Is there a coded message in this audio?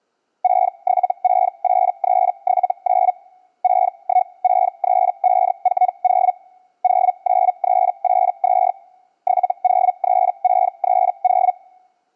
Yes: Hellschreiber (Feld-Hell, 122.5 baud) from 0.4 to 11.5 s, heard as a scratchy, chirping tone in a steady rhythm, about 740 Hz. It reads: 6768379 6163540 09382 703630